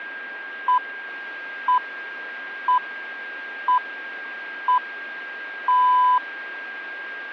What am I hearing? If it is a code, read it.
Radio time signal (six pips, as the Greenwich Time Signal), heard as pips, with a steady whistle near 1610 Hz.